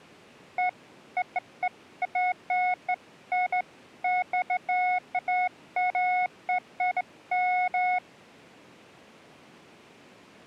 Beeps of irregular length. There is no code.